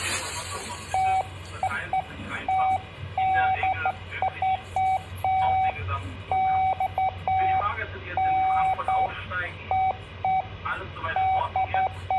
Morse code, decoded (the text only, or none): none